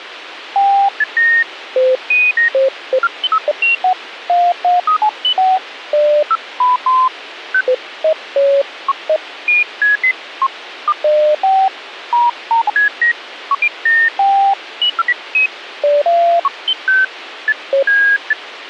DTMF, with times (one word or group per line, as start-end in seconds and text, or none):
none